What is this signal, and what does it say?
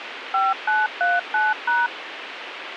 DTMF, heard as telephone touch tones, dialled by machine, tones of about 190 ms, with radio hiss. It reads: 5939#